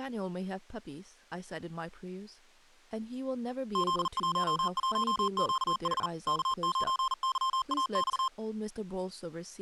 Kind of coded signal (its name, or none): Morse code